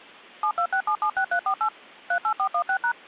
DTMF, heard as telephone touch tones, dialled by machine, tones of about 80 ms. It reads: 726776348 38416#